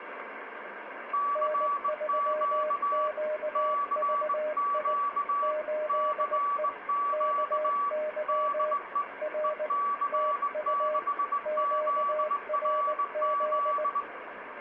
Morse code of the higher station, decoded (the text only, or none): CQ CQ CQ DE EC6ZRZ